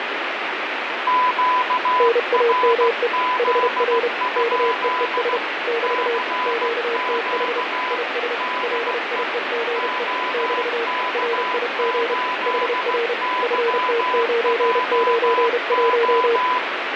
Morse code, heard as two keyed tones, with heavy radio static and fading. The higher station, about 16 wpm, 1000 Hz: QRZ? CQ DE OK8YJO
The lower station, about 31 wpm, 460 Hz: NAME HR KEES <BT> QTH IS LIEGE <BT> RIG HR FT991